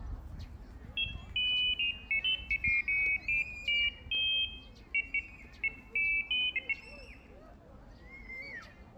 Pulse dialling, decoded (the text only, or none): none